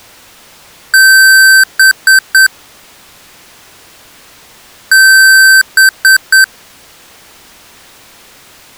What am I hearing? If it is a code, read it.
Beep code, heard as beeps from a small speaker, played twice, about 1550 Hz. 1 long, 3 short. In Award and IBM BIOS tables: video adapter failure; in AMI BIOS tables: memory failure.